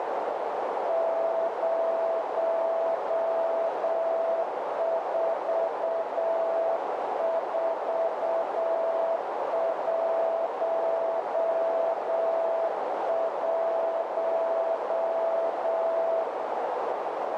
Morse code, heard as a keyed tone, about 7 wpm, 660 Hz, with heavy radio static and a narrow filter. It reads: 04411